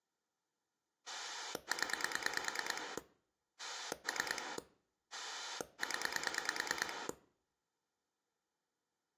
Pulse dialling, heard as a rotary dial, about 9 pulses a second. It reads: 0 3 0